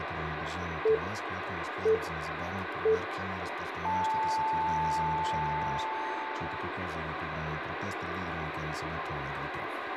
Radio time signal (three low pips and a long one an octave up, as on NHK), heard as pips, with radio hiss and room echo.